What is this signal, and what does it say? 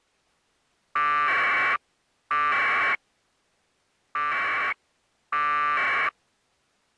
Packet radio (AX.25, as in APRS), 1200 baud, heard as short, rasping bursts.